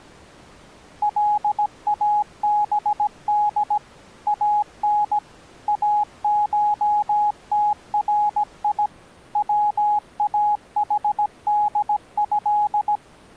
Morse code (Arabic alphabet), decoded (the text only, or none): لابد ان اشتري واحده